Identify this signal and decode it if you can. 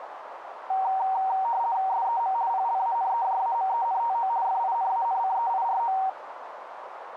RTTY (50 baud, 170 Hz shift), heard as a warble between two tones, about 850 Hz centre, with radio static and a narrow filter. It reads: SEM PLANEJAMENTO FINANCEIRO